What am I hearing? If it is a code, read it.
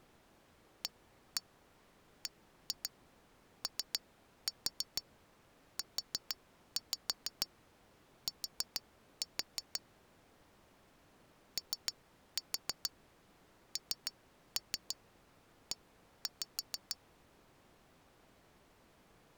Tap code, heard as taps on glass, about 6 knocks a second. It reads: ABOUT ONE